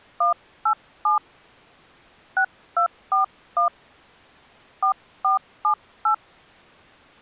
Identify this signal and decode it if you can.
DTMF, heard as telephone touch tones, dialled by hand, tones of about 110 ms. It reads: 187 6241 4478